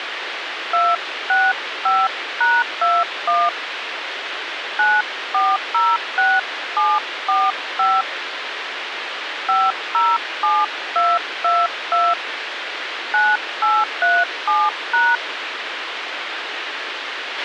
DTMF, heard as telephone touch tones, dialled by hand, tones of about 220 ms, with radio hiss and a squelch burst at the end. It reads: 265#21 9406745 507222 9837#